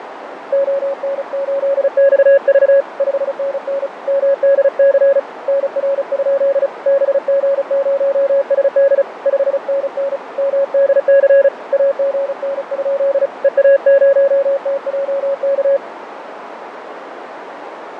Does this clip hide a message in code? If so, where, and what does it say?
Yes: Morse code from 0.5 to 15.8 s, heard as a keyed tone, hand-sent with a paddle, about 35 wpm, 550 Hz, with radio static, fading and a narrow filter. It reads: ON8XV 5NN MDC NR? BG0SD 5NN MDC AGN? EA0TJK